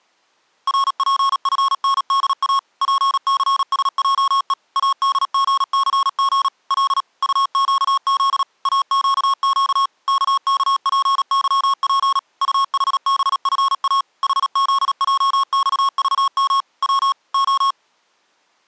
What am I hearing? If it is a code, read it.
Morse code, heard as electronic beeps, machine-sent, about 37 wpm, 1090 Hz. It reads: RPFNDA PCSJE ADGCG L UQZ AQQ KKPYP UHBFA HZJXVM W O